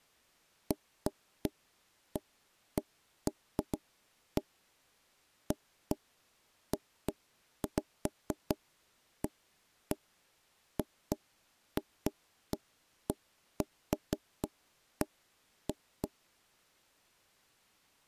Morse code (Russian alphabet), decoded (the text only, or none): none